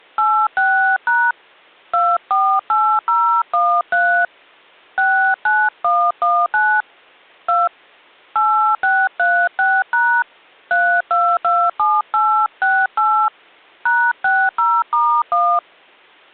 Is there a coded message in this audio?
Yes: DTMF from 0.2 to 15.6 s, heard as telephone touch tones, dialled by hand, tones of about 290 ms. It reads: 86# 248013 69119 2 8636# 3227868 #60*1